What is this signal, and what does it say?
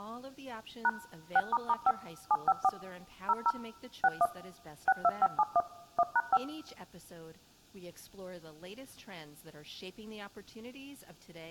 DTMF, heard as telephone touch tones, dialled by machine, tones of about 50 ms, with speech in English. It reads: # 6**5 754 00 61 62571 1#5